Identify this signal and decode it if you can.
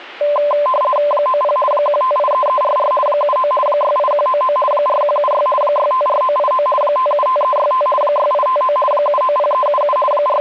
RTTY (50 baud, 450 Hz shift), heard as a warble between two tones, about 810 Hz centre. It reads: 90 1583344 79 68199 4176 654989 575365 6859 790377 …